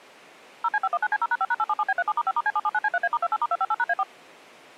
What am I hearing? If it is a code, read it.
DTMF, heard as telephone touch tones, dialled by machine, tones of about 40 ms. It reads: 0C519C0#5#877B37*5*C779C3A*28*258#A4